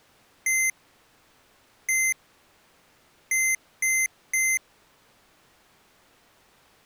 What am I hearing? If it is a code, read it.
Beep code, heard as beeps from a small speaker, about 2050 Hz. 1-1-3. In Phoenix BIOS tables: CMOS read or write failure.